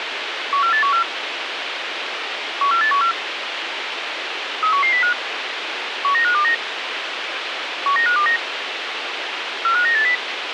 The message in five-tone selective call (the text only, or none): 14814 14814 31105 19529 19529 45980